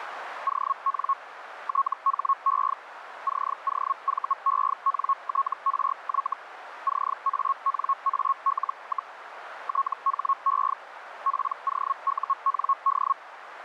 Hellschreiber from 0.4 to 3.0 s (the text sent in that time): ON THE